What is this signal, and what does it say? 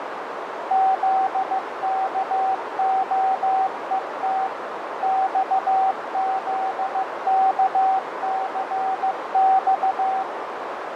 Morse code, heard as a keyed tone, machine-sent, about 15 wpm, 770 Hz, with heavy radio static, fading and a narrow filter. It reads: ZKOET XZKCX